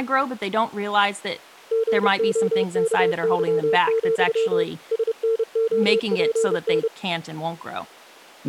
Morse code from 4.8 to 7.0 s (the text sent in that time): SNOPN